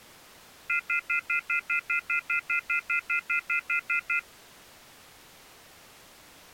Telephone call progress tone (North American plan), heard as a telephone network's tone, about 1400, 2050, 2450, 2600 Hz, 0.1 s on and 0.1 s off. Off-hook warning tone.